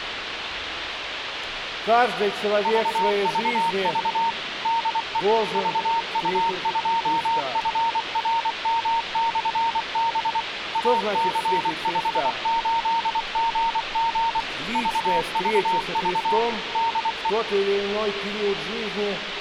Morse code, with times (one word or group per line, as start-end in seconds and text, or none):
2.7-4.3 VVV
4.7-5.2 DE
5.6-10.4 VU2FRM/B
10.8-14.4 AC58GG
14.8-16.4 VVV
16.8-17.3 DE